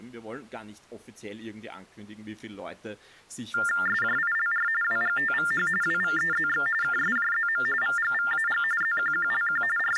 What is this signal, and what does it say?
TTY/TDD text telephone tones (45.45 baud Baudot), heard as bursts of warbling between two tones, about 400 Hz shift, 1600 Hz centre, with speech in German. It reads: SJILR WGTVH WVEZX KSJZM VGVAG ZQQLQ …